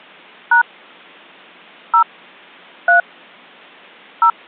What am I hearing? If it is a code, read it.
DTMF, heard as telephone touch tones, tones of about 100 ms. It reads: # 0 3 0